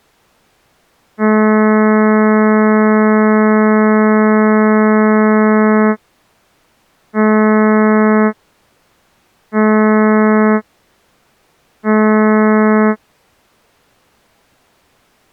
Ship horn signal, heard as a ship's horn, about 220 Hz. 1 long, 3 short. At sea: a vessel under tow in fog.